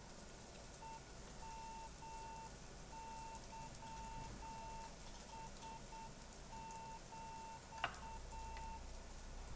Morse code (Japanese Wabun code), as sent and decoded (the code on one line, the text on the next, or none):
. -- -.-- ... --..-
ヘヨケラヒ